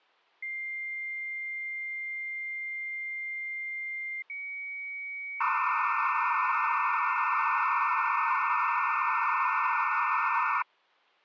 Dial-up modem handshake (low-speed, two carriers), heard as two whistles, then hiss.